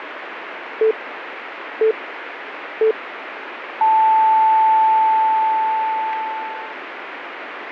Radio time signal (three low pips and a long one an octave up, as on NHK), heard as pips, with radio static.